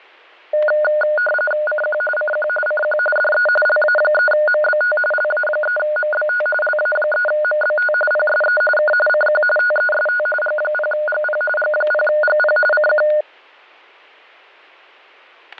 RTTY (45.45 baud, 850 Hz shift), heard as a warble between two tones, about 1030 Hz centre, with static crashes. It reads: CQ CQ CQ DE LA3MBT LA3MBT LA3MBT PSE K CQ TEST G0GP G0GP CQ